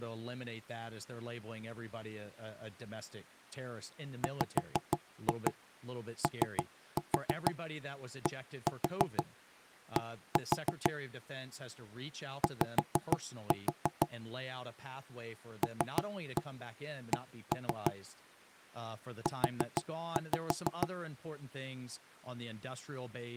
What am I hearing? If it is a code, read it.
Tap code, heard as knocks on wood, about 6 knocks a second, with speech in English. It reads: WODD Y LC U